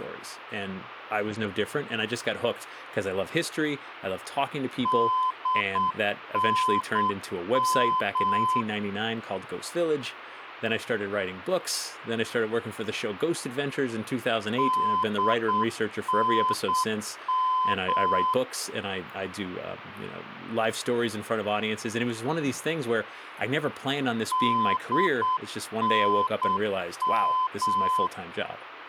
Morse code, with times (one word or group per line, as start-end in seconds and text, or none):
4.9-8.6 DNM
14.6-18.3 DNM
24.3-28.1 DNM